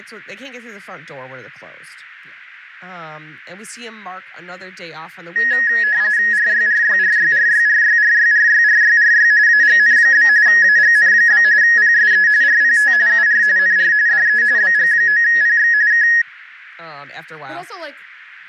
RTTY (45.45 baud, 170 Hz shift), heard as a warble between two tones, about 1800 Hz centre, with radio static and speech in English. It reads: RYRYRYRYRYRYRYRYRY AGN? AGN? PSE RPT UR NR DE BG9PX K